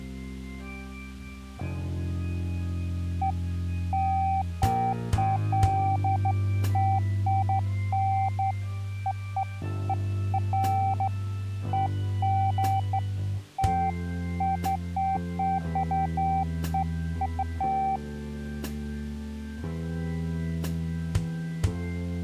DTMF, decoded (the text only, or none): none